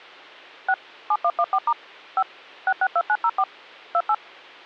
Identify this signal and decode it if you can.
DTMF, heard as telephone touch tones, dialled by machine, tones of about 60 ms, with hum. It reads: 6 7114* 5 662904 28